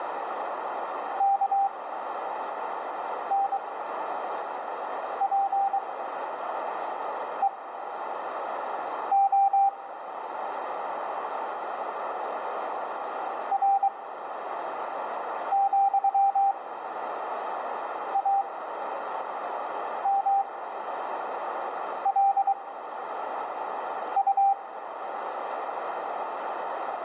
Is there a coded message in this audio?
Yes: Morse code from 1.1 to 24.6 s, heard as a keyed tone, machine-sent, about 23 wpm, spaced as for 5 wpm, 790 Hz, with radio static and a narrow filter. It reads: KNPEO R,AMLU